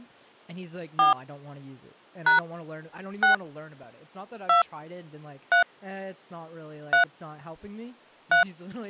DTMF, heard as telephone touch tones, dialled by hand, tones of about 120 ms, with speech in English. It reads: 4 # 6 2 3 3 3